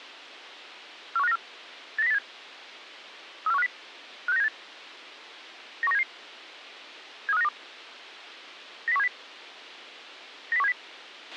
Five-tone selective call (EEA), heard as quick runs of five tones, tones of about 40 ms, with a squelch burst at the end. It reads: 41594 89087 34150 56978 91977 73592 90170 90170